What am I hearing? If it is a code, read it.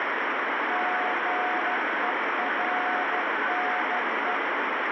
Morse code, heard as a keyed tone, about 13 wpm, 730 Hz, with heavy radio static. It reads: GERNE